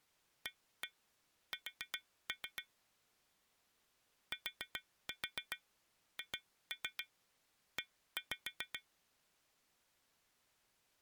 Tap code, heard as taps on glass, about 7 knocks a second. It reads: AS THE